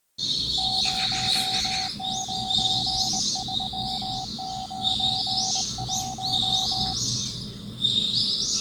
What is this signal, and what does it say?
Morse code, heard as a keyed tone, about 22 wpm, 760 Hz, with the noise of a park. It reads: 09391